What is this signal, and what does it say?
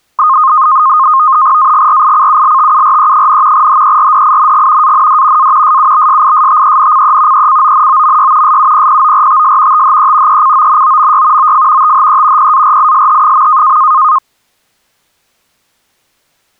NAVTEX (SITOR-B), 100 baud, 170 Hz shift, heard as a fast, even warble, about 1150 Hz centre. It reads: AGRICULTURE, HERDING AND A SUBSISTENCE ECONOMY SUPPORTS THE ECONOMY OF THE PARISH.